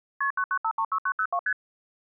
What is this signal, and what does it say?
Multi-frequency trunk signalling (R1, as on North American trunks), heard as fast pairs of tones, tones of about 70 ms. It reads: KP 99536902 ST